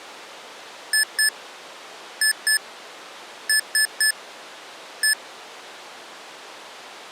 Beep code, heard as beeps from a small speaker, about 1750 Hz. 2-2-3-1. In Phoenix BIOS tables: unexpected interrupt.